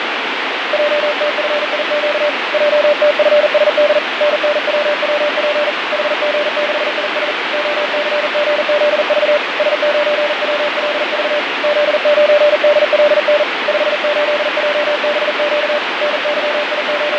Morse code, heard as a keyed tone, hand-sent with a paddle, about 40 wpm, 590 Hz, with heavy radio static and fading. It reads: JTFIQ JTFSD NNWWP HG6IS OCGZV S9WLV Z9DLN 58JBQ …